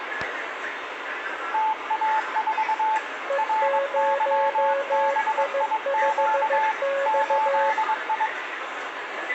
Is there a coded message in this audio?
Yes: Morse code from 1.5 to 8.3 s, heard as two keyed tones, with radio static, room echo and the noise of a crowd indoors. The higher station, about 22 wpm, 870 Hz: TA4 RYBIQ 8I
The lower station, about 15 wpm, 550 Hz: E0I5X